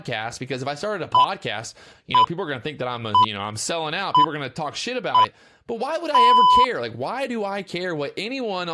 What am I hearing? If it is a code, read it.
Radio time signal (six pips, as the Greenwich Time Signal), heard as pips, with speech in English.